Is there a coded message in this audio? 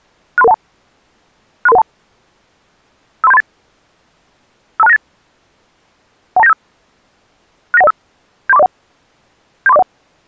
Yes: five-tone selective call (EIA) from 0.4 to 9.8 s, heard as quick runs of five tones, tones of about 30 ms. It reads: 63312 63312 53738 52698 12975 69105 73401 73401